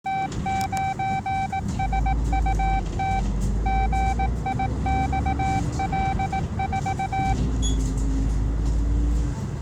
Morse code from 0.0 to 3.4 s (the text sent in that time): T9SUT